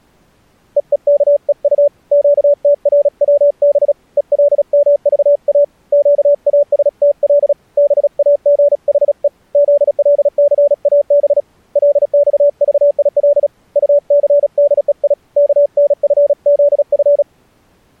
Morse code, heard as a keyed tone, hand-sent with a paddle, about 36 wpm, 580 Hz. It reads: EEKEU QTRWB ELMVA QASTL BAGHE ZLCAB LXVIL UCDEI KNFZF